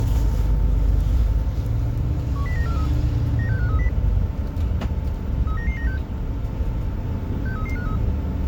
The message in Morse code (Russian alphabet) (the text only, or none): none